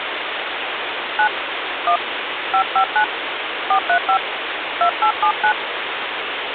DTMF, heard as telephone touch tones, dialled by hand, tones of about 80 ms, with phone line noise. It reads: 9 1 559 435 2879